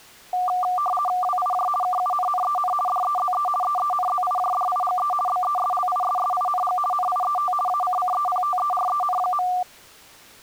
RTTY (50 baud, 450 Hz shift), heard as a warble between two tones, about 950 Hz centre. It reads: WIJ KUNNEN DEZE EENZIJDIGE BESLISSING NIET ACCEPTEREN.